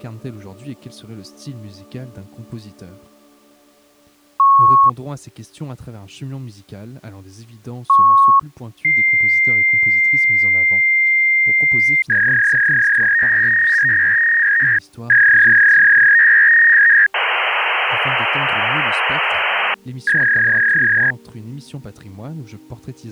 Fax machine handshake, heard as beeps, a long tone, a warble and hiss.